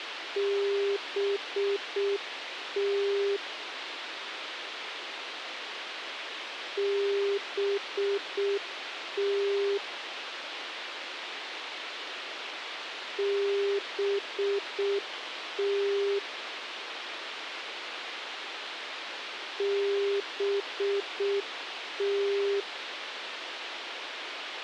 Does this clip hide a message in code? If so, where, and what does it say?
Yes: Morse code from 0.3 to 22.7 s, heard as a keyed tone, machine-sent, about 6 wpm, 400 Hz, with radio hiss and a squelch burst at the end. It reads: BT BT BT BT